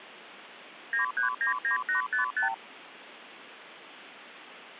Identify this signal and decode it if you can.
Multi-frequency trunk signalling (R2, with the far end's replies), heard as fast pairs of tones, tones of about 120 ms, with phone line noise. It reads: 9399855